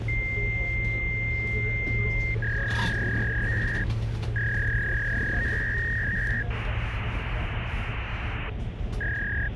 Fax machine handshake, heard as a long tone, a warble and hiss, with phone line noise and the noise inside a bus.